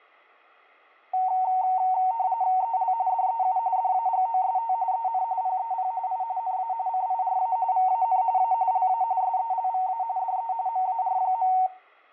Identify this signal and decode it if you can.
RTTY (45.45 baud, 170 Hz shift), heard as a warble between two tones, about 830 Hz centre, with room echo. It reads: EL DEU DAGOST EN PEP I NA CIRA VAN A LA SELVA DE MAR.